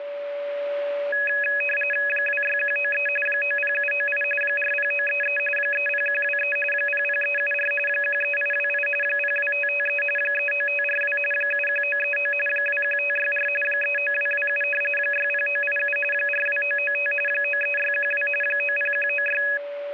RTTY (45.45 baud, 850 Hz shift), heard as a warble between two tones, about 2100 Hz centre, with a steady whistle near 570 Hz. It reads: 26193 90798 40933 30123 00374 13828 02553 39542 71939 21564 39227 60987 42995 93612 90196